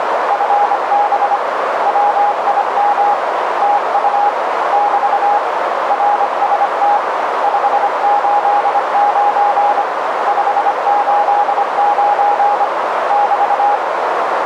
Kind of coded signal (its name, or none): Morse code